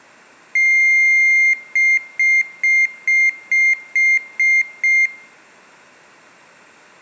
Beep code, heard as a piezo beeper, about 2100 Hz, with room echo. 1 long, 8 short. In AMI BIOS tables: display or retrace test failure.